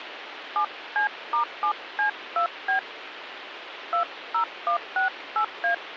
DTMF, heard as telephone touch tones, dialled by hand, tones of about 100 ms, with phone line noise. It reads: 7C*7C2B 20168A